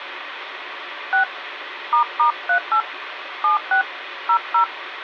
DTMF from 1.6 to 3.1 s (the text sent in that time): **38